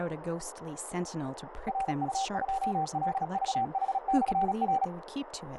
Morse code, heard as a keyed tone, machine-sent, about 36 wpm, 780 Hz, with radio static, a narrow filter and speech in English. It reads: RU2LVH/R